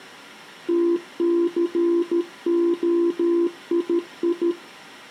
Morse code (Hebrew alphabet), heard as a keyed tone, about 13 wpm, 340 Hz, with room echo. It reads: תסהיי